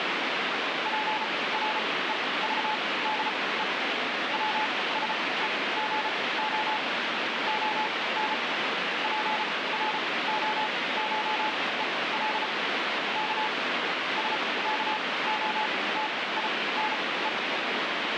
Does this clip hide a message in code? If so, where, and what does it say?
Yes: Morse code (Russian alphabet) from 0.8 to 17.3 s, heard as a keyed tone, machine-sent, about 34 wpm, spaced as for 20 wpm, 860 Hz, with heavy radio static. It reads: ПРЕЖДЕ ВСЕГО ОН ПРОШЕЛ К СКОТИНЕ